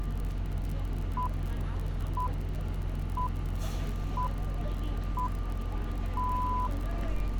Radio time signal (six pips, as the Greenwich Time Signal), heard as pips, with street noise.